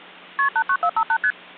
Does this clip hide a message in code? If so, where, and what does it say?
Yes: multi-frequency trunk signalling (R1, as on North American trunks) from 0.4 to 1.3 s, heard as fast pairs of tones, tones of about 70 ms. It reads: KP 89458 ST